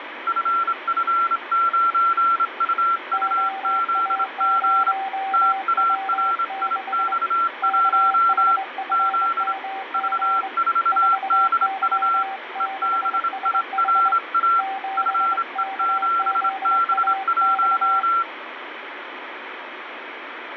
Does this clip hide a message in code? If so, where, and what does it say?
Yes: Morse code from 0.2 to 18.3 s, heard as two keyed tones, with radio static. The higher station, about 26 wpm, 1360 Hz: FF9UUZG TARIX1 Z V4DU EBIRA FE7B1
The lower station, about 24 wpm, 780 Hz: OA0W6 KHFMG 4Y6SH 7KZAX